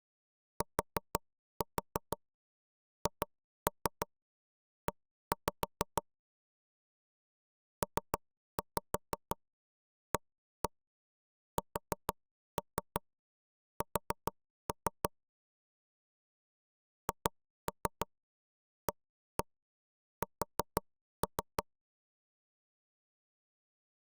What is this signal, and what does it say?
Tap code, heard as knocks on wood, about 6 knocks a second. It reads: THE PASS HAS